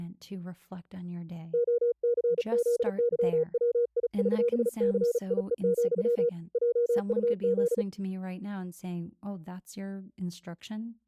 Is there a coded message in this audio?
Yes: Morse code (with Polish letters) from 1.5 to 7.9 s, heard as a keyed tone, hand-sent with a paddle, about 36 wpm, 480 Hz, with speech in English. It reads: OCZYWIŚCIE, JUZ